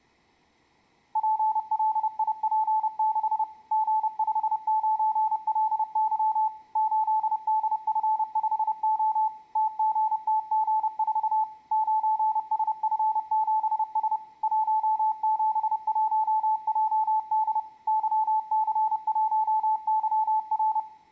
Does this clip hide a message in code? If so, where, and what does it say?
Yes: Morse code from 1.1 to 20.9 s, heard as a keyed tone, machine-sent, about 30 wpm, 870 Hz, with room echo. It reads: PLIP6 G59LY 8DF5O TGTG4 9SF7S 171JD YC1YR